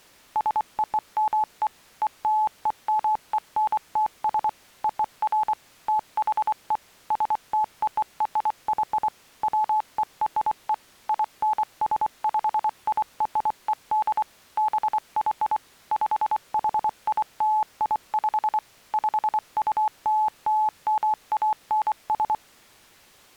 Morse code (American railroad code), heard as a keyed tone, machine-sent, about 860 Hz. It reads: SOME ELEMENTS OF THE STORY WERE INSPIRED BY PHILIP PULLMANS